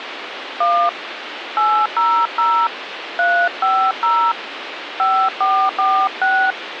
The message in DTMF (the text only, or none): 1 800 350 5446